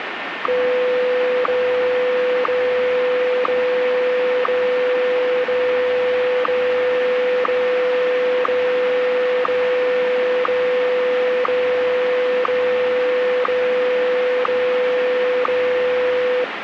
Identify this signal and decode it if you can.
Radio time signal (WWVH, Hawaii), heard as ticks, one a second, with radio static.